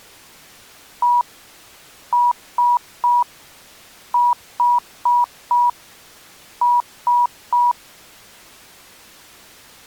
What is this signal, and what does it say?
Beep code, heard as beeps, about 970 Hz. 1-3-4-3. In Phoenix BIOS tables: memory failure on data bits.